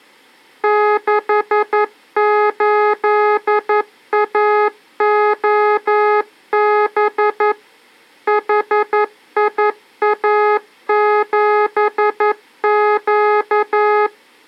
Morse code, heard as electronic beeps, machine-sent, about 11 wpm, 420 Hz. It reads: 68AOB HIA7Q